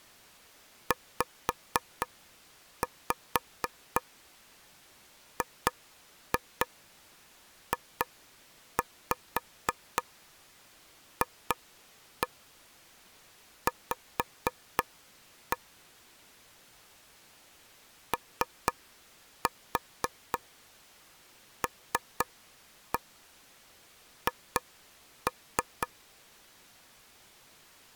Tap code, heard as taps on a table, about 4 knocks a second. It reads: ZGJFV OLH